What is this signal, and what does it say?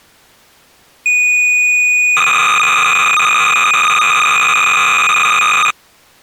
Cassette data (Kansas City type), 300 baud, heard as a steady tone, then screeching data.